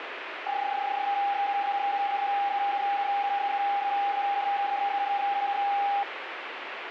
PSK31 (31.25 baud), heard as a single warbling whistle, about 800 Hz, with radio static.